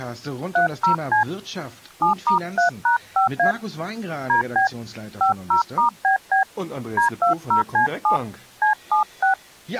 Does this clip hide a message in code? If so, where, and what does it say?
Yes: DTMF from 0.6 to 9.3 s, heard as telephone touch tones, dialled by hand, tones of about 120 ms, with speech in German. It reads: 30C 7*3#5A DB 50*BB D20C7 C76